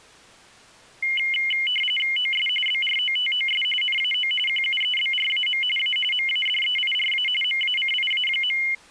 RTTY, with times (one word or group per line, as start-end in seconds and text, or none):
2.2-2.5 OS
2.7-3.6 BROTOS
3.8-4.3 NAO
4.5-5.6 QUEBRAM
5.8-6.0 A
6.1-7.3 MADEIRA
7.4-8.6 MACIA.